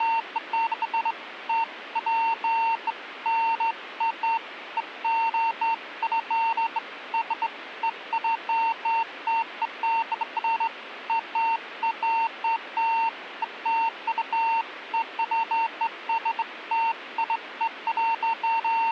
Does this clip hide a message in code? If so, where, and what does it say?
No, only beeps of irregular length, with radio hiss.